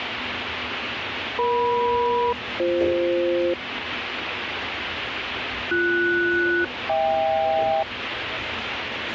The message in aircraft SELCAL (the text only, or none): EM-BF BS-HK